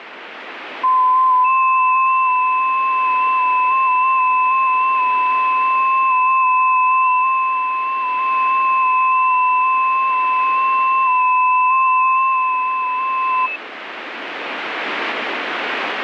FT8 (several signals at once), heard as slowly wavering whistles, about 6.25 baud, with radio static.